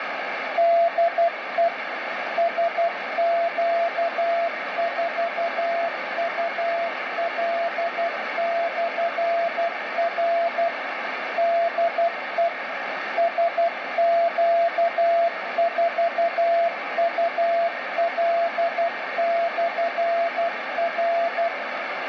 Morse code, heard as a keyed tone, machine-sent, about 12 wpm, 680 Hz, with heavy radio static. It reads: DE SQ4UL/R DE SQ4UL/R